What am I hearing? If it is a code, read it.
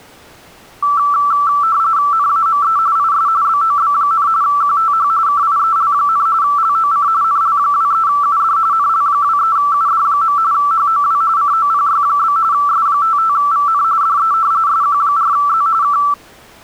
RTTY (45.45 baud, 170 Hz shift), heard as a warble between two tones, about 1240 Hz centre. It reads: NAME IS BOB, QTH KIEL, LOC NL23UD NL23UD. HOW COPY? S55VN DE SQ4Z K